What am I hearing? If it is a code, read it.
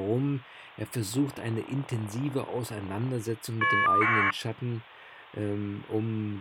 Caller ID data burst, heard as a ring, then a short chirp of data, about 1200 baud, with speech in German.